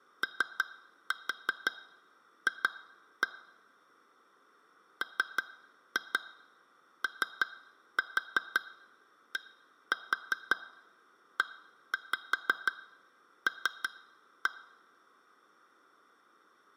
Tap code, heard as taps on glass, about 5 knocks a second. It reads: OF MODEL